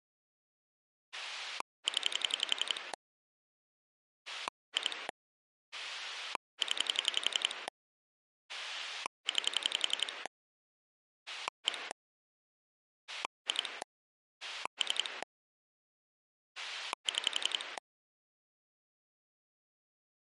Pulse dialling, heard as a rotary dial, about 11 pulses a second. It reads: 0 2 0 9 1 2 3 6